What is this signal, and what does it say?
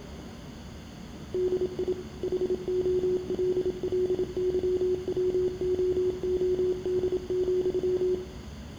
Morse code, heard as a keyed tone, machine-sent, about 27 wpm, 370 Hz, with room echo and the noise inside a subway train. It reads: DI HOLLYWOOD,